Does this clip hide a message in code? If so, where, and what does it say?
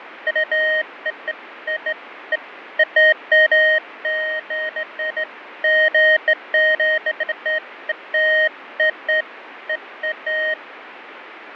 No, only beeps of irregular length, with radio static and fading.